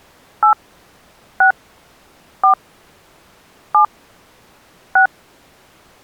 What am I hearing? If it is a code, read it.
DTMF, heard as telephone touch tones, dialled by hand, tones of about 100 ms. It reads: 8 6 4 7 6